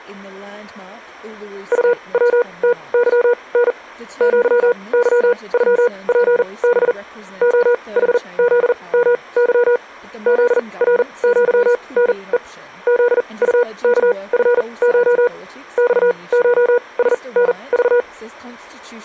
Morse code (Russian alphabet), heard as a keyed tone, machine-sent, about 40 wpm, spaced as for 26 wpm, 480 Hz. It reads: УВТЫН ЪЫЮПБ ОХЗМЫ ЗРЪНЕ ЗУКФШ ЬШСНЖ